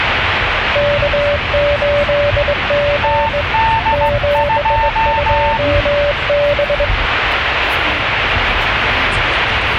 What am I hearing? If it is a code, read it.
Morse code, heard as two keyed tones, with radio static and the noise inside a car. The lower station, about 20 wpm, 580 Hz: K8G 72B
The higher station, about 15 wpm, 900 Hz: TD2